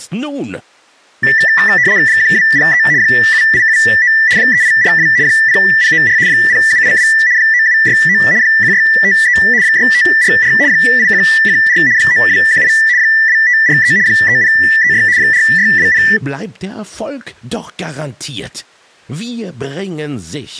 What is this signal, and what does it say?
RTTY (75 baud, 170 Hz shift), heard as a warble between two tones, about 1850 Hz centre. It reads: 1203 7879 3842 0094 0782 9769 1653 6544 8114 9218 2543 3036 4620